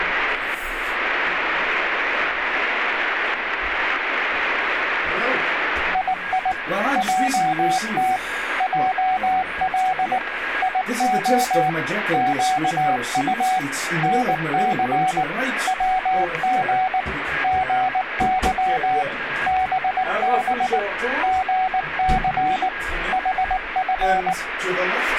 Morse code, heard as a keyed tone, machine-sent, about 19 wpm, 750 Hz, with radio static and a weaker station near 1640 Hz. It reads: II JT JL IO QU NC WG GY BB GC HF